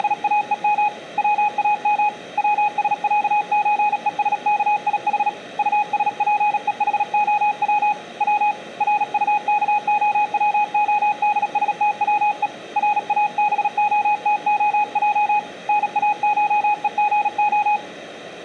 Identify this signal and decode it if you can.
Morse code (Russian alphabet), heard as a keyed tone, hand-sent with a paddle, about 37 wpm, 840 Hz, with room echo. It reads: … ВАМ ВСЯЧЕСКИХ УСПЕХОВ В РУКОВОДСТВЕ РАБОТОЙ НАШЕГО